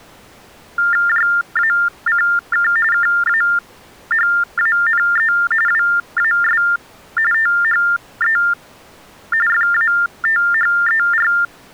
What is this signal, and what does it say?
TTY/TDD text telephone tones (45.45 baud Baudot), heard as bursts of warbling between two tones, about 400 Hz shift, 1600 Hz centre. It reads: JACK KAHANE WAS THE FATHER